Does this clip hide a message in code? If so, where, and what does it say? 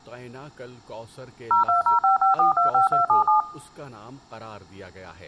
Yes: DTMF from 1.5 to 3.4 s, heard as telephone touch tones, dialled by machine, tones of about 130 ms, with speech in Urdu. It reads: 02055425277